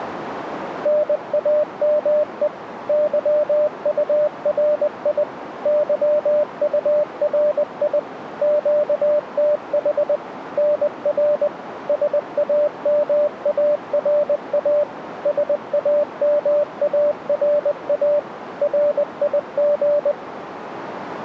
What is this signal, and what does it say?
Morse code, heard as a keyed tone, machine-sent, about 20 wpm, 590 Hz, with radio static and a narrow filter. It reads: NAME YURI YURI QTH NR SAMARA SAMARA RIG